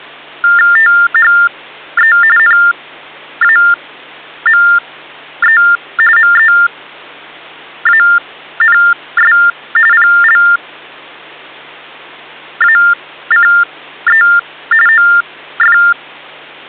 TTY/TDD text telephone tones (45.45 baud Baudot), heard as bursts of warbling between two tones, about 400 Hz shift, 1600 Hz centre, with hum. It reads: THE NAME MEANS PLACE OF